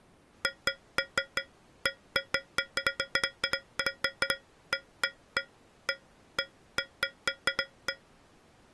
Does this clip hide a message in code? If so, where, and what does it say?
No, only irregular taps on a metal pipe.